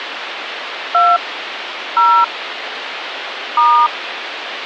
DTMF, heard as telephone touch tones, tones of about 280 ms, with phone line noise. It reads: 2 0 *